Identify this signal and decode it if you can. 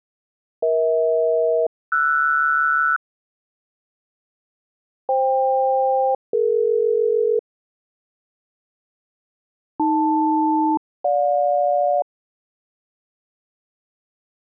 Aircraft SELCAL, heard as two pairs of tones. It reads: EH-RS FK-DE AL-GJ